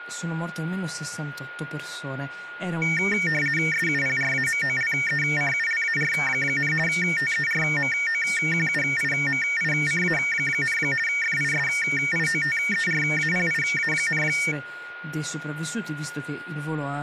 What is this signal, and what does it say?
RTTY (50 baud, 450 Hz shift), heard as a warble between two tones, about 2050 Hz centre, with a steady whistle near 1430 Hz and speech in Italian. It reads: SUPRAMOLECULAR, TERMOQUIMICA, FISIOTERAPIA,